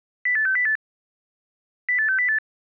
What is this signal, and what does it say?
Five-tone selective call (CCIR), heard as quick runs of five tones, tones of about 100 ms. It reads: 08608 08608